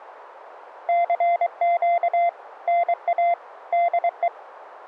Morse code, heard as a keyed tone, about 23 wpm, 690 Hz. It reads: CQ NA DE